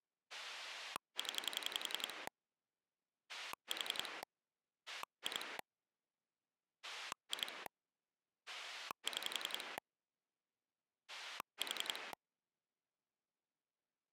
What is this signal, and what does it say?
Pulse dialling, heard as a rotary dial, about 11 pulses a second. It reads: 0 4 2 2 6 4